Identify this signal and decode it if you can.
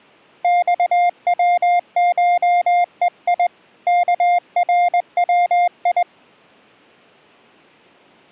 Morse code (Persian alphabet), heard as a keyed tone, hand-sent with a straight key, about 20 wpm, 710 Hz. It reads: خوشهی کروی